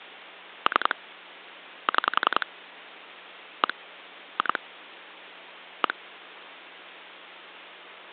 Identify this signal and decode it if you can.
Pulse dialling, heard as clicks on a phone line, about 10 pulses a second, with phone line noise. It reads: 3 6 1 2 1